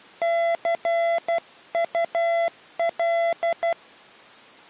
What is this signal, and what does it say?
Morse code, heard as a keyed tone, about 12 wpm, 680 Hz. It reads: CUL